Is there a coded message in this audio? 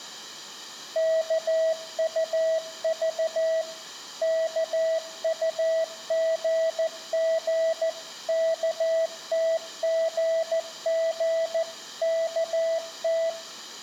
Yes: Morse code (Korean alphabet) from 0.9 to 13.4 s, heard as a keyed tone, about 14 wpm, 650 Hz, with room echo. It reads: 일 있었어